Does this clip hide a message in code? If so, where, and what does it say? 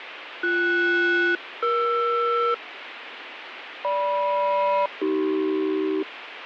Yes: aircraft SELCAL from 0.4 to 6.0 s, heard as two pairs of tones, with radio static. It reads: BS-ER GM-AC